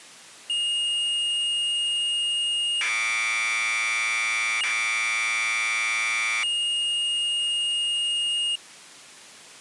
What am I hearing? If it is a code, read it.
Commodore tape loading (standard loader), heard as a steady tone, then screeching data.